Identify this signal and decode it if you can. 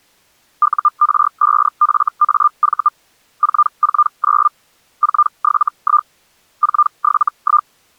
Hellschreiber (Feld-Hell, 122.5 baud), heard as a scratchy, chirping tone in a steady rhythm, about 1200 Hz. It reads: UR5FAV 449 471 471